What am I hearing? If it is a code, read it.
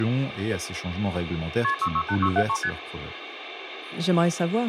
Multi-frequency trunk signalling (R1, as on North American trunks), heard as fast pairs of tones, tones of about 70 ms, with phone line noise and speech in French. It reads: KP 668673 ST